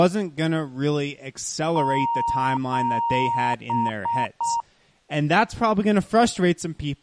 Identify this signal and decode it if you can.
Beep code, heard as beeps, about 930 Hz, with speech in English. 2 long, 3 short.